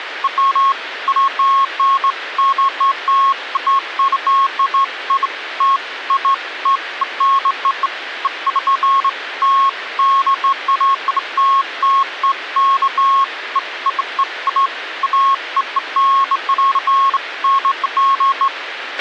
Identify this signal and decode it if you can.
Beeps of irregular length, with radio hiss and a squelch burst at the end. There is no code.